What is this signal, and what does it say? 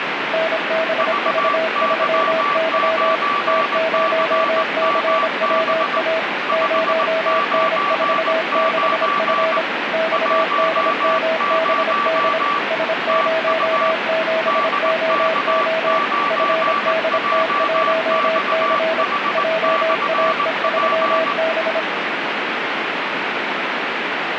Morse code, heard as two keyed tones, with heavy radio static. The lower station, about 26 wpm, 650 Hz: NBV3Y T0CWA 0N46F XDMBD S07OO FDT1C JAE3B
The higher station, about 19 wpm, 1160 Hz: VY9CMB 599 10 TU DK9JXH/P